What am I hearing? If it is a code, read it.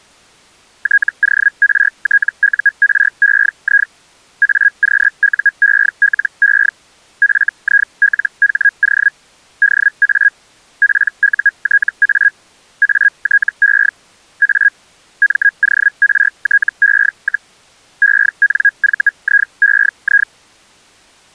Hellschreiber (Feld-Hell, 122.5 baud), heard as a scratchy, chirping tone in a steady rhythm, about 1650 Hz. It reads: TORTUREI AQUELE FILHO DA PUTA ATE A MORTE, ENVIEI